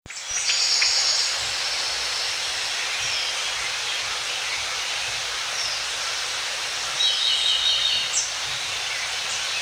The noise of a park. There is no code.